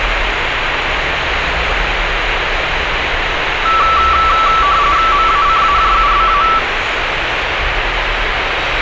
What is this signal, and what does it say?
RTTY (45.45 baud, 170 Hz shift), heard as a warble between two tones, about 1240 Hz centre, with radio static and street noise. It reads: MACAJUBA